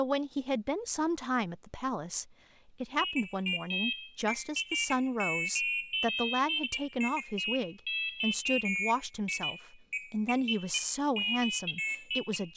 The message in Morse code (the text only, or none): none